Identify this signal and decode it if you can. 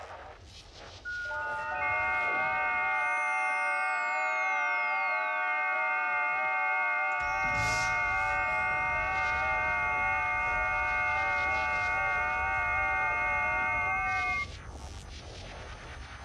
FT8 (several signals at once), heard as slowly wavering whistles, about 6.25 baud.